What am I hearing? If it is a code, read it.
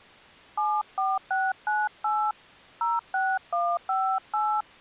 DTMF, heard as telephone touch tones, dialled by hand, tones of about 240 ms. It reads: 74698 06158